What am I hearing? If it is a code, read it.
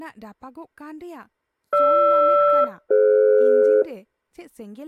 Aircraft SELCAL, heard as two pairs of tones, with speech in Santali. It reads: GR-DF